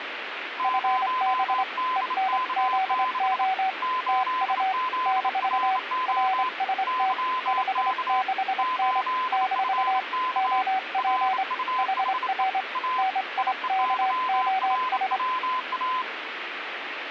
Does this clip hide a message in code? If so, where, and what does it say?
Yes: Morse code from 0.5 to 16.1 s, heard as two keyed tones, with radio static. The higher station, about 28 wpm, 1020 Hz: 0DK6 8ZRO YK 8FK RUHE A IEYRWA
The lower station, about 25 wpm, 760 Hz: FB ENZO TU - RST 56N - OP HR NIKOS